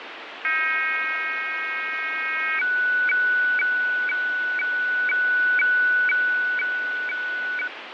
Weather fax (radiofax), 120 lines a minute, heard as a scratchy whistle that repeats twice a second, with radio static and fading.